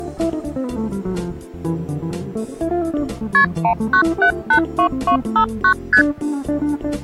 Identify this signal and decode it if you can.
Multi-frequency trunk signalling (R1, as on North American trunks), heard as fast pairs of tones, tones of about 90 ms. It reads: KP 19782259 ST